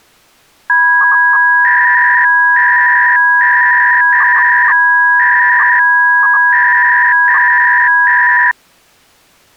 300-baud modem data (V.21 tones), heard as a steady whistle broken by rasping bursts, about 300 baud, 200 Hz shift.